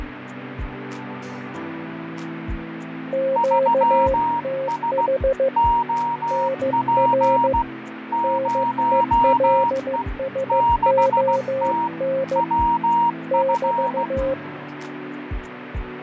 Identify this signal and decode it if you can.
Morse code, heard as two keyed tones, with radio static and fading. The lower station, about 15 wpm, 540 Hz: QTH NR NELSON <BT>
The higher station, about 16 wpm, 940 Hz: 3S OP 0E 6T WF